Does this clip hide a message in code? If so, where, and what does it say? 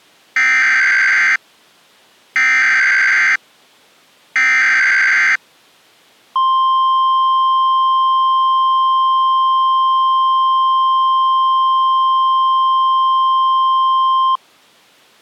Yes: Emergency Alert System (SAME) tones (header bursts, then the 1050 Hz attention tone) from 0.4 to 14.4 s, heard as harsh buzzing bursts, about 520.83 baud.